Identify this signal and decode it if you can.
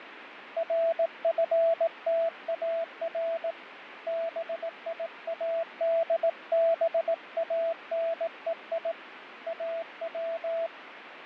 Morse code (Persian alphabet), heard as a keyed tone, hand-sent with a paddle, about 18 wpm, 660 Hz, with radio static and fading. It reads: رفتار بیادبانهی او